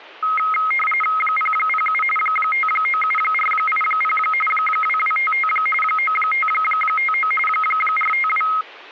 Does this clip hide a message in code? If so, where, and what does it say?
Yes: RTTY (45.45 baud, 850 Hz shift) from 0.2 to 8.6 s, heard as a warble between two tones, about 1700 Hz centre. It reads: 007 597480 2255 9559 452